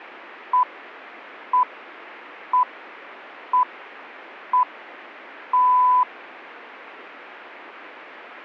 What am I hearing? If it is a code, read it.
Radio time signal (six pips, as the Greenwich Time Signal), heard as pips.